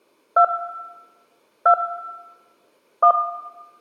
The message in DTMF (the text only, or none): 2 2 1